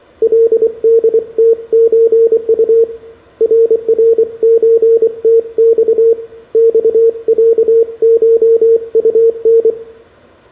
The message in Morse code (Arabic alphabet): لدتزط ررزتص صعشطن

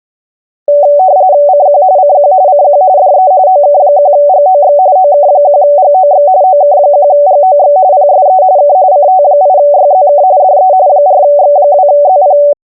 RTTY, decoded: CQ CQ CQ DE OK1GOX OK1GOX OK1GOX PSE K CT8YZK DE 4X2ZP

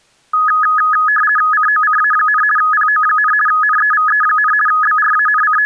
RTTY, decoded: COCA, PO, NEVE, …

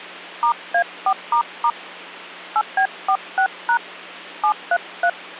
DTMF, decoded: *A4** 8B46# 733

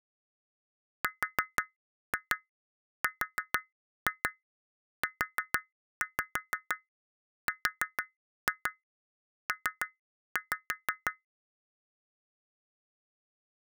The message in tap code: RRURP

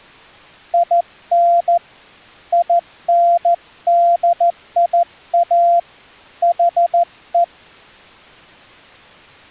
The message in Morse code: IN INDIA HE

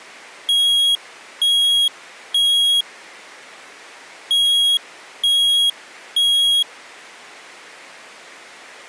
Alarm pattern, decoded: temporal three

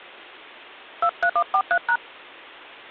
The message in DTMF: 23143#

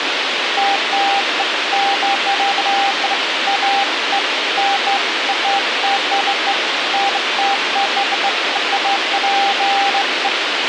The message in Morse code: none

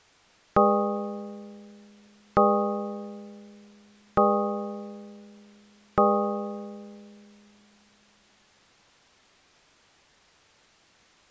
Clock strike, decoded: 4

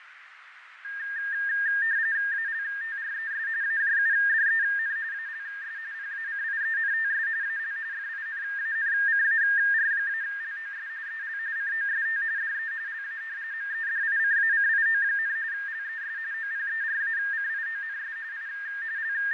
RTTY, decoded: ALTRES AJUDEN ALS PACIENTS AL FINANCAR-LOS EL COST DE LA MEDICACIO, LES OPERACIONS I …

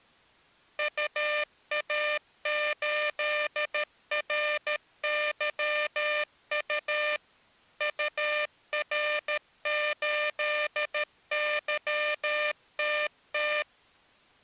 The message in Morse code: UA8RYU UR8YTT

